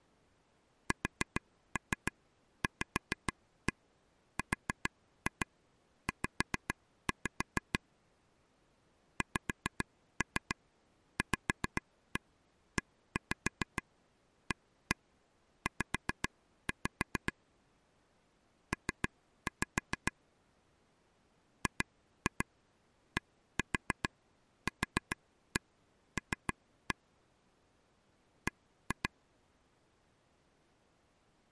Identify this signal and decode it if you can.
Tap code, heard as taps on a table, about 6 knocks a second. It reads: SVRZ XVEAZ P GDQL B